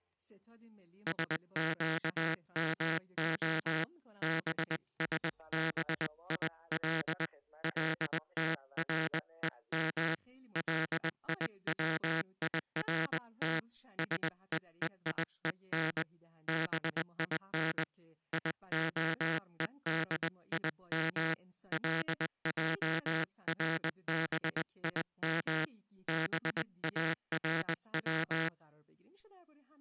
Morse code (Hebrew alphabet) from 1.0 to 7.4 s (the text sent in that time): שקמה בשביל